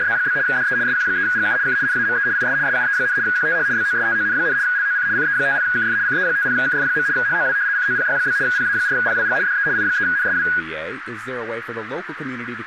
RTTY (75 baud, 170 Hz shift), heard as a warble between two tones, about 1550 Hz centre, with radio static, a narrow filter and speech in English. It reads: … DE SQ3GU K NAME IS SUE, QTH BOSTON, LOC CE50KF CE50KF. HOW COPY? PA4PWG DE I3NSW